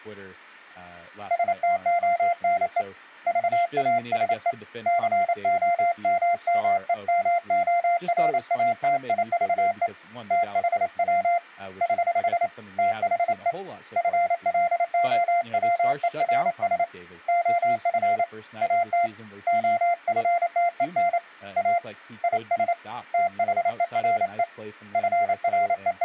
Morse code, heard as a keyed tone, hand-sent with a paddle, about 28 wpm, 690 Hz, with speech in English. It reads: STONE VASE COMMEMORATIVE THW <HH> THE FLOWERS OF AT OFTEN A IS THERE …